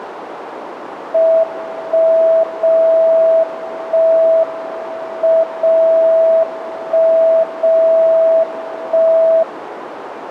Radio time signal (WWVB), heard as a tone whose level steps once a second, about 650 Hz, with radio static and a narrow filter. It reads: 1 0 1 M 0 1 0 1